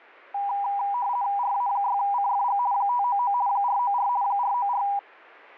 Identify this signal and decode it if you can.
RTTY (50 baud, 170 Hz shift), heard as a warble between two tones, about 890 Hz centre. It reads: RA6CFG 599 494 494